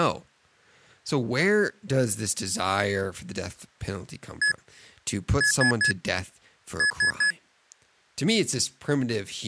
Beep code, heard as beeps from a small speaker, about 1700 Hz, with speech in English. 1-3-3. In Phoenix BIOS tables: chip or data line failure in the first 64 KB of memory.